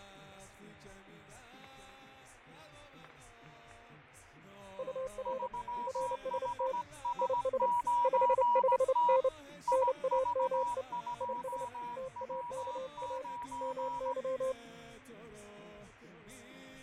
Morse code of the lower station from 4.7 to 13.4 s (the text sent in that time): UR RST IS 55N NAME IS TAKA